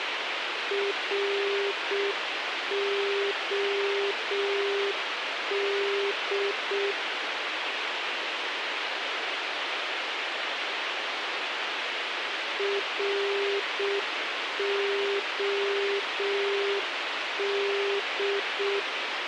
Morse code, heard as a keyed tone, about 6 wpm, 400 Hz, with radio hiss. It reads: ROD ROD